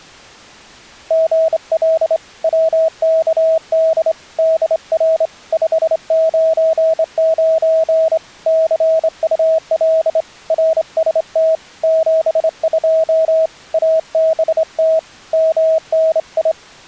Morse code, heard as a keyed tone, hand-sent with a straight key, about 26 wpm, 640 Hz. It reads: GL WKD DR 599 CUL RST 72 ABT MNI